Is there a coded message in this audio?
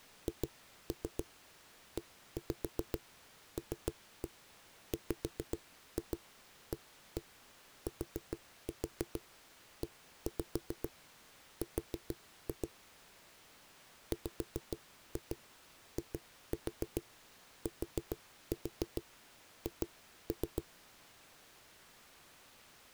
Yes: tap code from 0.3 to 20.7 s, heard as knocks on a wall, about 7 knocks a second. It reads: HELWATER WITH